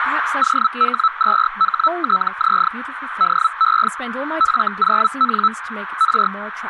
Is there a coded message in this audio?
Yes: Hellschreiber (Feld-Hell, 122.5 baud) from 0.4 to 6.3 s, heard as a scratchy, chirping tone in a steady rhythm, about 1310 Hz, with radio static, a narrow filter and speech in English. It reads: OH2HTZ DE F0N R